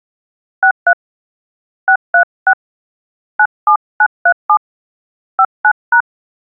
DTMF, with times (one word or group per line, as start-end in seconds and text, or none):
0.6-0.9 63
1.9-2.5 636
3.4-4.6 97937
5.4-6.0 59#